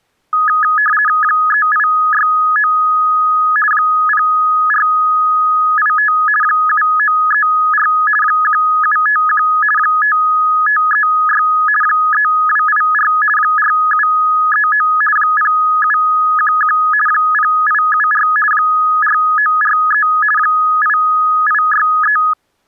RTTY (50 baud, 450 Hz shift), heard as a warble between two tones, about 1480 Hz centre. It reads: 3869 0485 7934 1751 5536 3284 4739 0711 0874 4943 8863